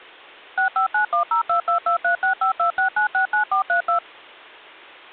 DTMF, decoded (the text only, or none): 6591022236526969432